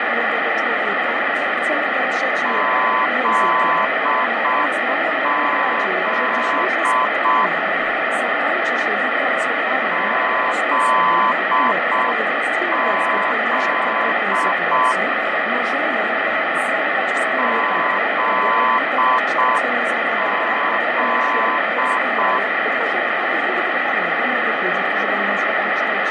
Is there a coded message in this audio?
Yes: Morse code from 2.4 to 22.4 s, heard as a keyed tone, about 6 wpm, 1020 Hz, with radio static and fading. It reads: ZZ ZZ ZZ